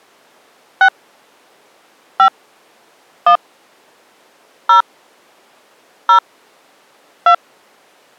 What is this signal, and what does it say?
DTMF, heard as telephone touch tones, dialled by hand, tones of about 90 ms. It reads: 6 5 1 0 0 2